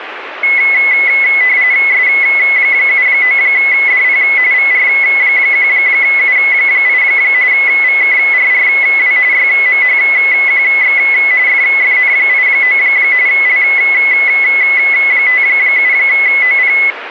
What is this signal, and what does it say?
RTTY (45.45 baud, 170 Hz shift), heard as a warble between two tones, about 2100 Hz centre, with radio static. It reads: S79DP VR1U8 VKRRW YMHQX FFN89 L57OP